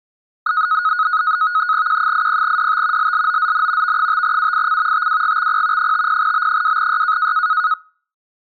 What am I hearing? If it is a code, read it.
NAVTEX (SITOR-B), 100 baud, 170 Hz shift, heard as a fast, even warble, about 1360 Hz centre. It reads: Q80DT LLOZN V5UIC TWGXP 50B2Y